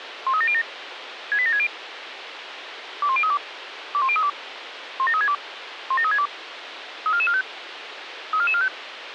Five-tone selective call (ZVEI), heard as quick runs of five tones, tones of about 70 ms, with radio hiss. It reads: 13707 68760 21032 21032 17362 17362 34445 34445